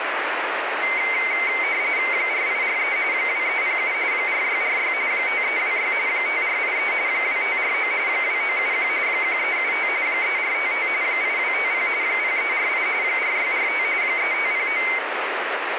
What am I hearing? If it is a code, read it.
RTTY (45.45 baud, 170 Hz shift), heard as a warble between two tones, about 2150 Hz centre, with radio static. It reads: 4843 2307 4646 5326 5483 2549 2971 1375 3455 8250 0348 4645 3509